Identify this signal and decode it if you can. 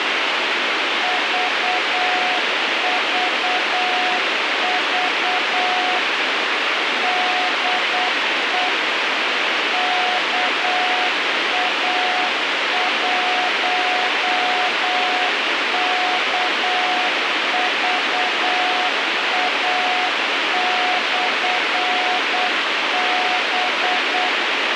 Morse code, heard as a keyed tone, machine-sent, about 8 wpm, 730 Hz, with radio hiss. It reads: VVV DE KA1KVA/B